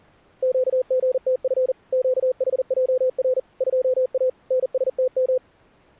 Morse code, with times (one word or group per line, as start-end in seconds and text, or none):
0.4-1.7 QGTF
1.9-3.4 QHJR
3.6-4.3 2A
4.5-5.4 NSTM